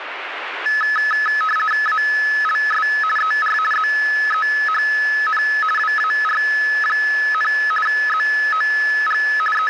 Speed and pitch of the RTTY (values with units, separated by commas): 50 baud, 450 Hz shift, 1500 Hz centre